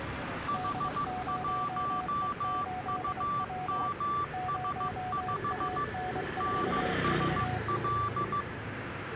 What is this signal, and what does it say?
Morse code, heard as two keyed tones, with radio static and street noise. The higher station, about 15 wpm, 1160 Hz: H1UMS5 NSL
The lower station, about 24 wpm, 740 Hz: D0E8W 0AN4V